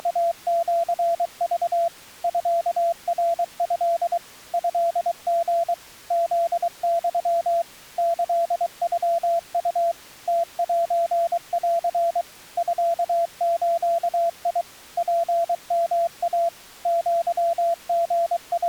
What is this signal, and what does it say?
Morse code (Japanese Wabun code), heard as a keyed tone, machine-sent, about 23 wpm, 680 Hz. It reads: … ミナト トリ フユ キノウ ムセン ミズ ツヨイ …